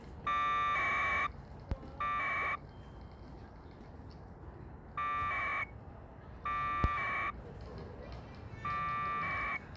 Packet radio (AX.25, as in APRS), 1200 baud, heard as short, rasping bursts, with the noise of a residential street.